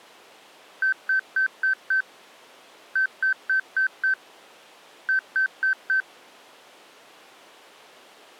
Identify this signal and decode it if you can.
Beep code, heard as beeps, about 1550 Hz. 5-5-4.